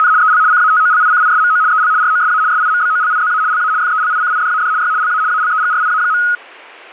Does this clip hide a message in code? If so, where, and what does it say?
Yes: RTTY (75 baud, 170 Hz shift) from 0.0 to 6.4 s, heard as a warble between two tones, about 1360 Hz centre. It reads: … EL CATOLICISMO EL ROSA SIMBOLIZA LA FELICIDAD Y LA ALEGRIA.